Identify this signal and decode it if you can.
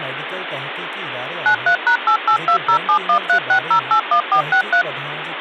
DTMF, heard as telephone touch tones, dialled by machine, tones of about 90 ms, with phone line noise and speech in Sindhi. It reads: 93#88207136081463